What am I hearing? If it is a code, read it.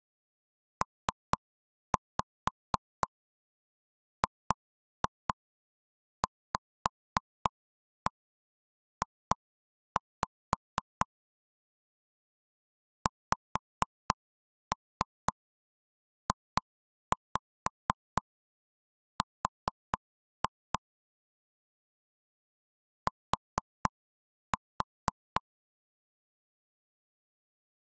Tap code, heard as taps on a table, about 4 knocks a second. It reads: PGVJ XJR T